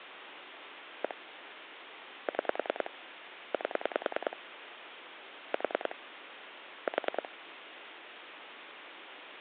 Pulse dialling, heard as clicks on a phone line, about 10 pulses a second, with phone line noise. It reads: 1 6 8 4 4